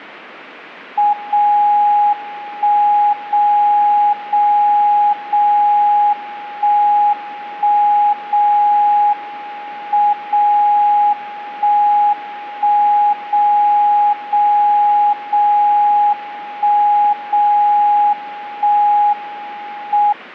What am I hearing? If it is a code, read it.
Radio time signal (WWVB), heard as a tone whose level steps once a second, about 830 Hz. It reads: 0 1 0 0 0 1 1 0 M 0 1 1 0 0 0 1 0 1 M